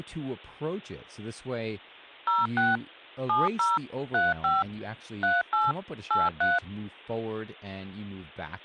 DTMF, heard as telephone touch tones, dialled by machine, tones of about 180 ms, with speech in English. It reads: 06 70 35 38 83